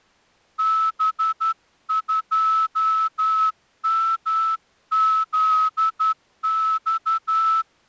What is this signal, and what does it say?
Morse code, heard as a whistle, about 11 wpm. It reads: B2MZX